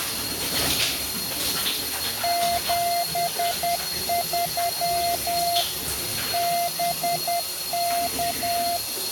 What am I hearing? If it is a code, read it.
Morse code, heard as a keyed tone, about 10 wpm, 690 Hz, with radio static and the noise of a restroom. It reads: 73 BK